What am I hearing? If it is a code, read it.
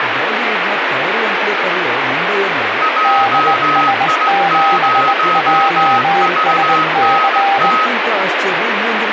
Morse code, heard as two keyed tones, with heavy radio static and speech in Kannada. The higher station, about 17 wpm, 1270 Hz: JI0VNT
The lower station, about 20 wpm, 790 Hz: DS7JSC